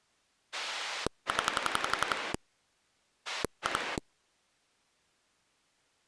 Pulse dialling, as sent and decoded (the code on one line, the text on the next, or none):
10 / 2
0 2